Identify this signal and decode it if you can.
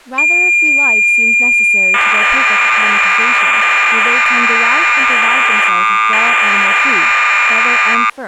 Cassette data (Kansas City type), 1200 baud, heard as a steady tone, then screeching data, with speech in English.